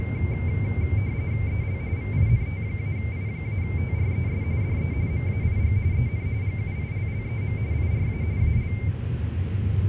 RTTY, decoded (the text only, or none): EL VINT-I-TRES DE MAIG EN GUILLEM IRA AL